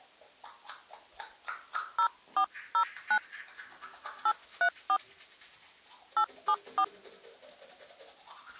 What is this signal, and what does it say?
DTMF, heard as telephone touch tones, dialled by hand, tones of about 80 ms, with the noise of a restroom. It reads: 0409 834 874